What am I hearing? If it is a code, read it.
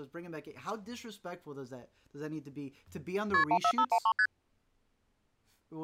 Multi-frequency trunk signalling (R1, as on North American trunks), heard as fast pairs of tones, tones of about 70 ms, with speech in English. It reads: KP 14513 ST